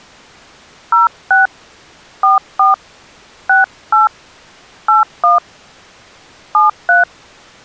DTMF, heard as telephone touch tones, dialled by hand, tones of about 150 ms. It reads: 06 44 68 81 73